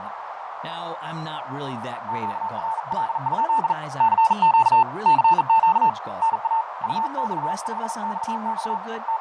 Morse code, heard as a keyed tone, hand-sent with a bug key, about 40 wpm, 890 Hz, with heavy radio static, fading, a narrow filter and speech in English. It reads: QRL? CQ CQ NA UX5XX …